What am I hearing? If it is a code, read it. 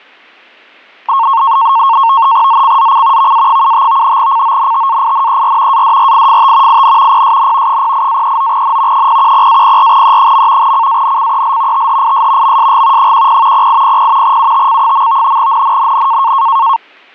NAVTEX (SITOR-B), 100 baud, 170 Hz shift, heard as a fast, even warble, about 1000 Hz centre, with static crashes. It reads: ZCZC VA75 CONTAINER ADRIFT IN PSN 08-39N 010-04E. CANCEL THIS MSG 10 0800 UTC. NNNN